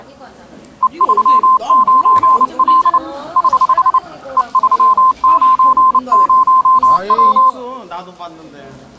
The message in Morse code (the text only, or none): E39L <HH> E390W